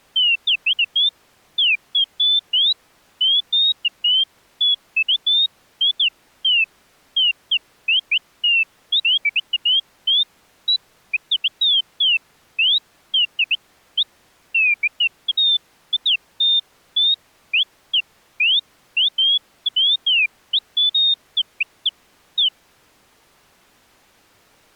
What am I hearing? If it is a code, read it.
Bird-like chirps. There is no code.